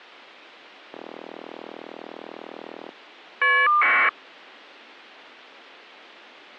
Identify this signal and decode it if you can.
Caller ID data burst, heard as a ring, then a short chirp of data, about 1200 baud.